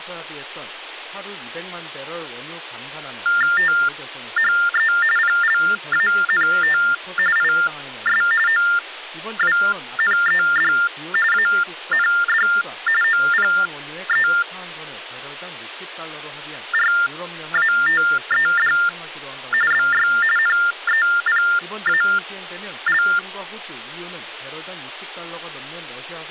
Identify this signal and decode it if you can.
TTY/TDD text telephone tones (45.45 baud Baudot), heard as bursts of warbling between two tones, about 400 Hz shift, 1600 Hz centre. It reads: THE PLANT IS OWNED AND OPERATED BY NEPAL